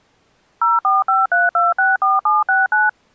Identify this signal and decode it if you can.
DTMF, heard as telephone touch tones, dialled by machine, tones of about 180 ms. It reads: 0453264769